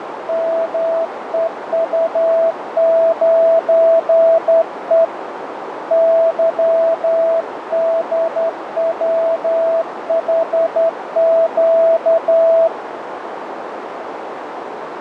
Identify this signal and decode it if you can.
Morse code, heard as a keyed tone, hand-sent with a straight key, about 11 wpm, 660 Hz, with radio static and a narrow filter. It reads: MEU9E YDWHQ